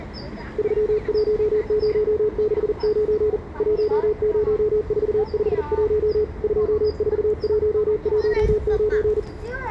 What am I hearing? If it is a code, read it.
Morse code, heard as a keyed tone, hand-sent with a paddle, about 40 wpm, 430 Hz, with the noise of a residential street. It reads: 31069 10451 24119